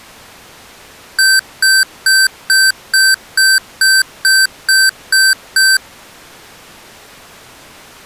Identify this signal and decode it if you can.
Beep code, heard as beeps from a small speaker, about 1550 Hz. 11 short. In AMI BIOS tables: cache memory error.